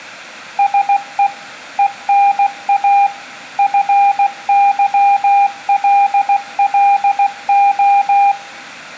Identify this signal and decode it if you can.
Morse code (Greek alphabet), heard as a keyed tone, machine-sent, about 16 wpm, 800 Hz, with room echo. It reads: ΣΕ ΕΝΑ ΦΥΛΛΟ